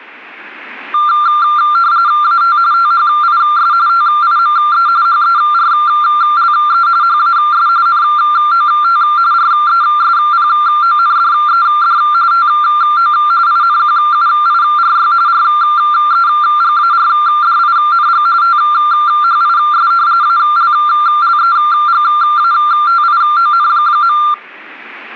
RTTY (45.45 baud, 170 Hz shift), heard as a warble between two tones, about 1280 Hz centre. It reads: AT THIS TIME HERLE HAS NOT RESPONDED TO INQUIRY REGARDING THIS ALLEGATION.